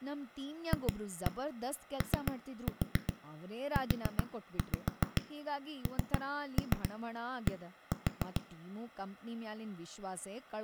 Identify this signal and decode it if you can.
Tap code, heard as knocks on a wall, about 7 knocks a second, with room echo and speech in Kannada. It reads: FOUND